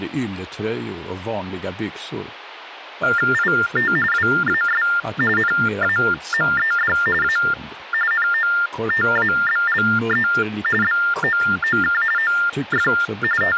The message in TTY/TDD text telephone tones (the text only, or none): IT WAS NAMED A NOTABLE BOOK OF …